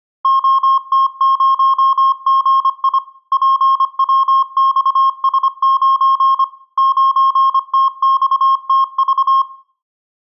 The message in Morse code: OT0GI PWXS9 9TXTV

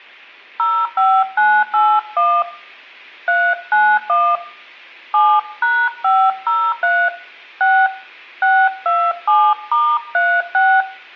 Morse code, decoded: none

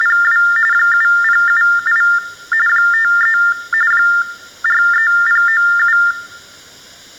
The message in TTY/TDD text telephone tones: … 7078 53 43097

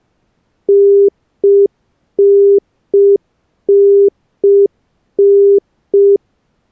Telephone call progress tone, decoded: congestion tone

